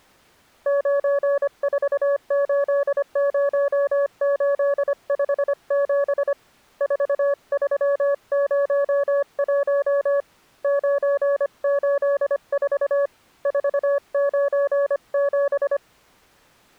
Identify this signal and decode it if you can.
Morse code, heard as a keyed tone, hand-sent with a paddle, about 25 wpm, 560 Hz. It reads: 9480857 4301 984 497